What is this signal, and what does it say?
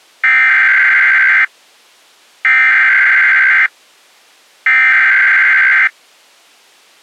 Emergency Alert System (SAME) tones (header bursts), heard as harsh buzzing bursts, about 520.83 baud.